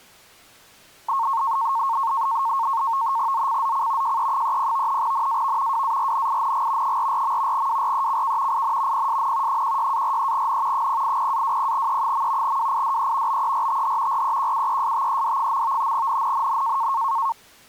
NAVTEX (SITOR-B), 100 baud, 170 Hz shift, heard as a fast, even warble, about 1000 Hz centre. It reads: ZCZC JE30 NAV WARNING 44. WRECK IN PSN 16-43N 080-20E. WIDE BERTH REQUESTED. NNNN